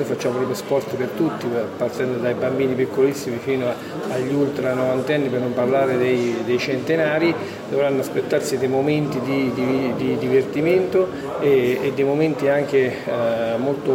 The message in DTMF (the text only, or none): none